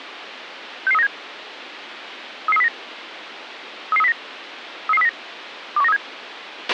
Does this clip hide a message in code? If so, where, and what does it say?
Yes: five-tone selective call (EEA) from 0.9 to 6.0 s, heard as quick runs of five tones, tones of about 40 ms, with radio hiss and a squelch burst at the end. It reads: 66397 33309 33309 33309 21937